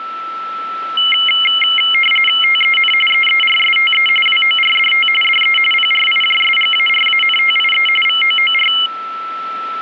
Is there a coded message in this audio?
Yes: RTTY (45.45 baud, 850 Hz shift) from 1.0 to 8.9 s, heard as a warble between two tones, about 2550 Hz centre, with a steady whistle near 1330 Hz. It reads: TEN EERSTE WORDT DE PRIJSGARANTIE VOOR